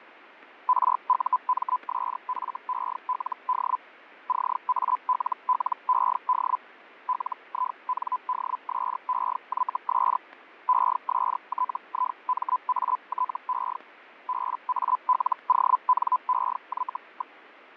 Hellschreiber (Feld-Hell, 122.5 baud), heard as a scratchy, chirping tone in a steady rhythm, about 1010 Hz, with radio static and fading. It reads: RUMSFELD CALLED LINDSEYS ESTIMATE BALONEY.